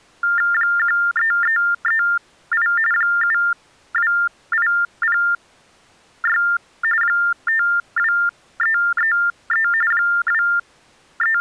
TTY/TDD text telephone tones (45.45 baud Baudot), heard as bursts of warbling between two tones, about 400 Hz shift, 1600 Hz centre. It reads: 13338 72806 52333 …